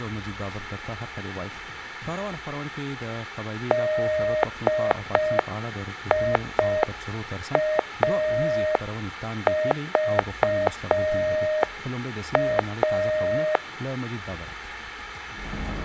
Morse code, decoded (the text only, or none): DIAVA